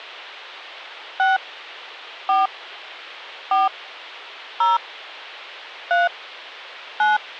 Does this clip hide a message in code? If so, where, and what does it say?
Yes: DTMF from 1.2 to 7.2 s, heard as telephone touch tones, dialled by hand, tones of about 170 ms. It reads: 6 4 4 0 3 9